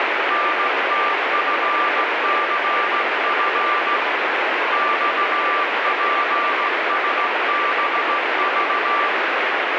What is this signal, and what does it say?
Morse code, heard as a keyed tone, hand-sent with a straight key, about 16 wpm, 1180 Hz, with heavy radio static. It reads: NTFCF XPSBV